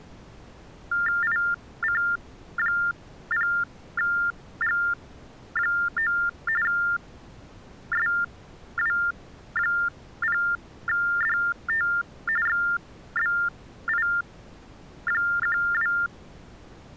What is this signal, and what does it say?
TTY/TDD text telephone tones (45.45 baud Baudot), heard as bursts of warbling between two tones, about 400 Hz shift, 1600 Hz centre. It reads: IC0G9 SW0DT XBI12